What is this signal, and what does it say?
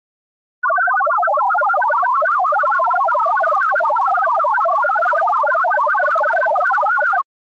Multi-tone FSK (Olivia or MFSK type), about 1000 Hz wide, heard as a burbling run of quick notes, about 62.5 baud.